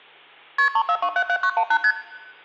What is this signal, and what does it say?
Multi-frequency trunk signalling (R1, as on North American trunks), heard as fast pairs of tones, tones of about 70 ms, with hum and room echo. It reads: KP 34277918 ST